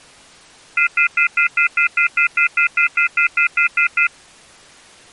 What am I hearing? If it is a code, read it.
Telephone call progress tone (North American plan), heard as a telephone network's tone, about 1400, 2050, 2450, 2600 Hz, 0.1 s on and 0.1 s off. Off-hook warning tone.